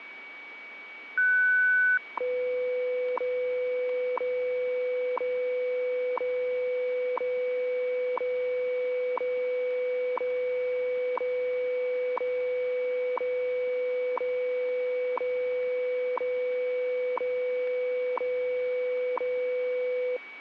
Radio time signal (WWV, Colorado), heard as ticks, one a second, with radio static and a steady whistle near 2270 Hz.